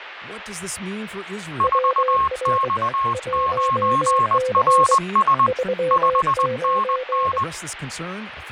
Morse code, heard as two keyed tones, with radio static and speech in English. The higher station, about 20 wpm, 1080 Hz: 4X9RS 5NN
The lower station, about 23 wpm, 510 Hz: WR 1C 39